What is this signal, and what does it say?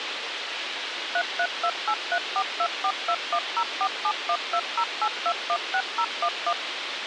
DTMF, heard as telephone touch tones, dialled by machine, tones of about 70 ms, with radio hiss. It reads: 33283424210471208216011